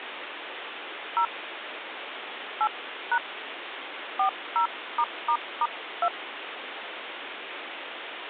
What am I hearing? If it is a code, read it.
DTMF, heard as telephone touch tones, dialled by hand, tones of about 70 ms, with phone line noise. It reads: 0 8# 40***2